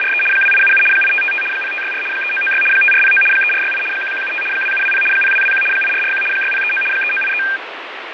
RTTY (75 baud, 850 Hz shift), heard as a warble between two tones, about 2000 Hz centre, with radio static and fading. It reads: … 2877 8555 0564 3996 5409 3468 1175 2720 0221 8441 6039 3983